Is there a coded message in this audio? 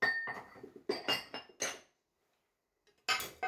No, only kitchen noise.